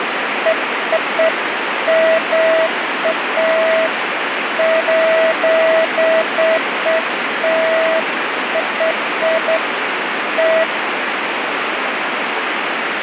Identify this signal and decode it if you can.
Beeps of irregular length, with radio static. There is no code.